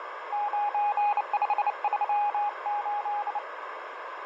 Morse code, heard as a keyed tone, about 29 wpm, 830 Hz, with radio static, fading and a narrow filter. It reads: 9538